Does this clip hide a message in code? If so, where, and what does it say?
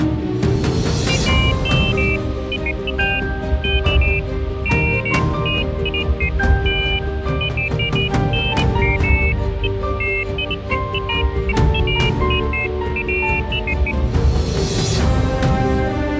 No, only pairs of high tones at irregular times, with radio hiss.